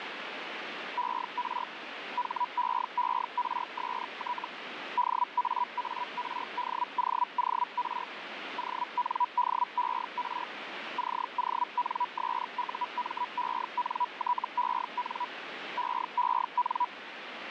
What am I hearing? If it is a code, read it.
Hellschreiber (Feld-Hell, 122.5 baud), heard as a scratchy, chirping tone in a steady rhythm, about 980 Hz, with radio static. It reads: ER HEERST DAARDOOR ONDER CONSUMENTEN EEN